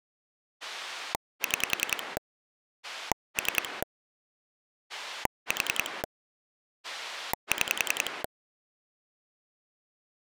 Pulse dialling, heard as a rotary dial, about 10 pulses a second. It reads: 6 3 4 6